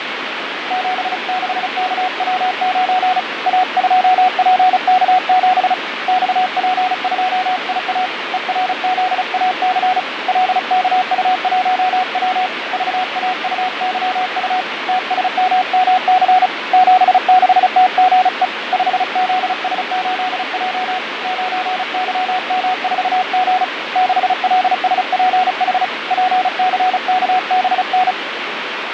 Morse code, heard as a keyed tone, hand-sent with a paddle, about 35 wpm, 740 Hz, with radio static and fading. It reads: 76KW9 A2PK7 XP2IA ERZAC LKU1W VAUYU TSMMC 76TGE 5ZS8J 9YM4G 6LSPH PCKBN